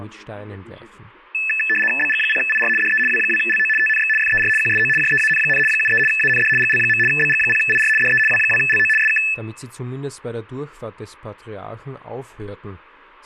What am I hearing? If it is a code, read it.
RTTY (75 baud, 850 Hz shift), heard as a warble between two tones, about 2150 Hz centre. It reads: BG0IR DE W2LO TNX FER QSO JEAN, 73 AND GL. BG0IR DE W2LO SK